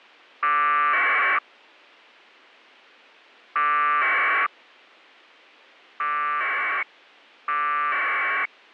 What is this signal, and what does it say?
Packet radio (AX.25, as in APRS), 1200 baud, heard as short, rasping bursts.